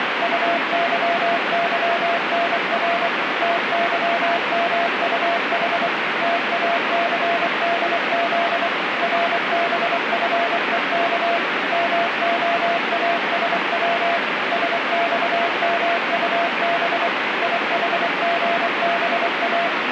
Morse code, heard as a keyed tone, machine-sent, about 24 wpm, 680 Hz, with heavy radio static. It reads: UYYNR TYMUH TACDZ RBFEK MOASW SXMUB IHGBA